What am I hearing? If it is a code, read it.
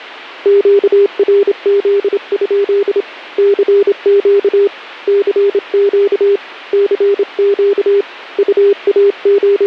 Morse code, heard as a keyed tone, hand-sent with a straight key, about 27 wpm, 400 Hz. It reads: QRZ? CQ CQ CQ …